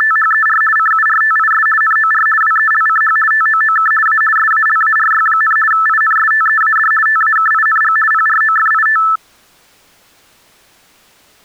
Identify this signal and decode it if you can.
RTTY (50 baud, 450 Hz shift), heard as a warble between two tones, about 1550 Hz centre. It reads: … CURTIS NOR WELCH TOOK A SALARY, INSTEAD TAKING PROFIT